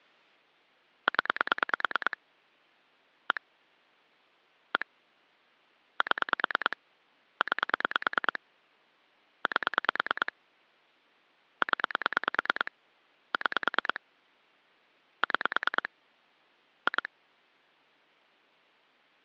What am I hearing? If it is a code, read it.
Pulse dialling, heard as clicks on a phone line, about 9 pulses a second. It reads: 0 1 1 7 9 8 0 6 6 2